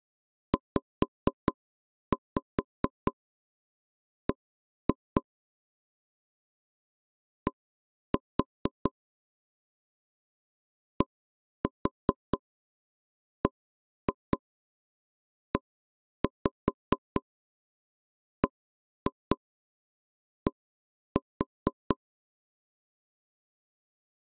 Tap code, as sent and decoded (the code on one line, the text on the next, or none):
5-5 1-2 / 1-4 / 1-4 1-2 1-5 1-2 1-4
ZB D DBEBD